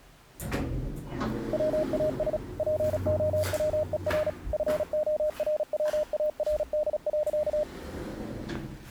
Morse code, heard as a keyed tone, machine-sent, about 36 wpm, 610 Hz, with the noise inside a lift. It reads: WAS POWER FORWARD.